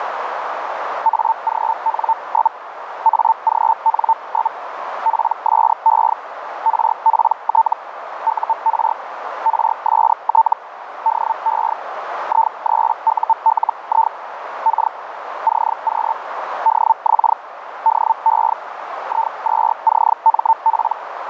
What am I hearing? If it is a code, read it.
Hellschreiber (Feld-Hell, 122.5 baud), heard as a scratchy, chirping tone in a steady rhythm, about 900 Hz, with radio static and a narrow filter. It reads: AGN? AGN? PSE RPT UR RST DE I3ULI K CQ DX DE I2CMP